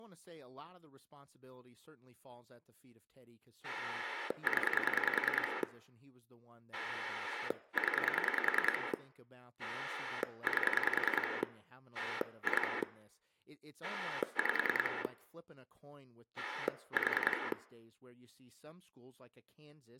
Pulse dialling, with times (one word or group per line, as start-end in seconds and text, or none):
3.6-5.6 0
6.7-8.9 0
9.6-11.4 8
11.9-12.8 2
13.8-15.0 5
16.4-17.5 4